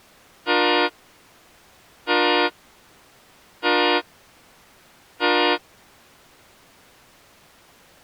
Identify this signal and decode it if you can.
Train horn signal, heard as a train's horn. 4 short. On North American railways: a request for a signal to be given or repeated.